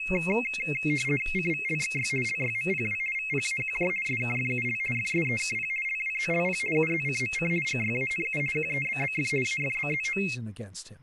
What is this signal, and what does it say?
RTTY (50 baud, 450 Hz shift), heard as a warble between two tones, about 2350 Hz centre, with speech in English. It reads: CVLXY LYMPW VPAQJ SKFUL FSEKP LWZLP UZCMC GYANU QEBBF AFBZO